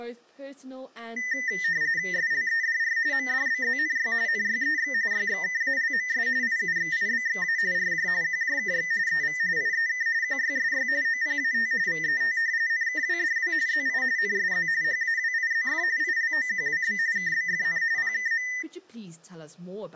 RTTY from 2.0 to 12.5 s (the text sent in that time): SLEDR MDBZNY NYEX YXKALMS IUXIBXA RJ QJKX EV IEK QYSY OPAT VET